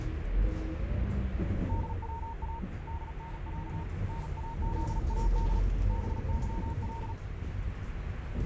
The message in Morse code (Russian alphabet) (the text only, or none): ДВА ДНЯ НАЗАД БЫЛ